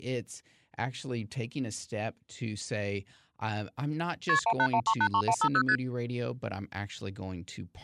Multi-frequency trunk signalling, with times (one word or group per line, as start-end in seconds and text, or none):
4.3-4.4 KP
4.5-5.6 181383150
5.7-5.8 ST